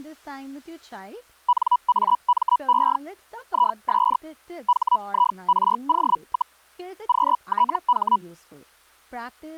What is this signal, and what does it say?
Hellschreiber (Feld-Hell, 122.5 baud), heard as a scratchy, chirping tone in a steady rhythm, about 980 Hz, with speech in English. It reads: NAME IS HIRO, QTH